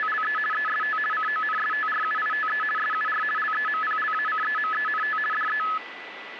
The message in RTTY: … EST CONSTRUITE SUR LEMPLACEMENT DE

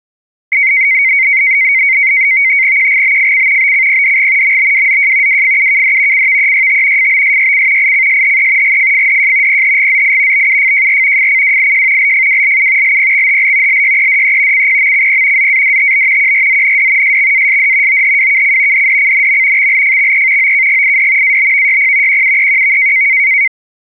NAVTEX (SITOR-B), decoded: QGBFC BCPDG MBWZJ WFUKD CVEYT FBSYC ICSHE GFFDJ PHGZI BUFJR FCWIJ LFWLU LPXHL LYEDE CPMCP ZADTB QRZND SXASD OHWKC DDCNM XLFXE OKGID ABVYP QUEQV

